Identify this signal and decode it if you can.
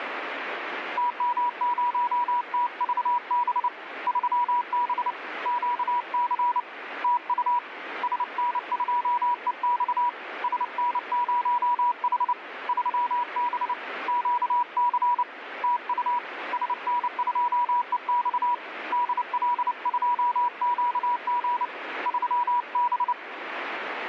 Morse code, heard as a keyed tone, hand-sent with a paddle, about 29 wpm, 970 Hz, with radio static. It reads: TM0TVB 3B QC TU SN2EX SN0H 3B QC TU SN2EX DL2QG 3B